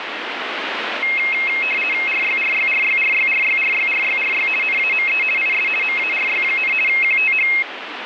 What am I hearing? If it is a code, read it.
RTTY (50 baud, 450 Hz shift), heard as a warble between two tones, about 2350 Hz centre, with radio static. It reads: RYRYRYRYRYRYRYRY NAME IS MARY, QTH